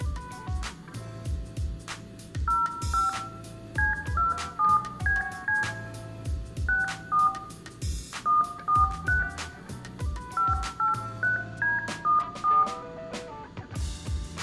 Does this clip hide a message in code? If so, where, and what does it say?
Yes: DTMF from 2.5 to 12.6 s, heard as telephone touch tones, dialled by hand, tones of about 160 ms, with room echo. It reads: 05 C27BC 64 143 583D14